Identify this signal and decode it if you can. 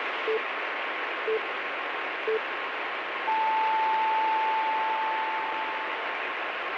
Radio time signal (three low pips and a long one an octave up, as on NHK), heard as pips, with radio static.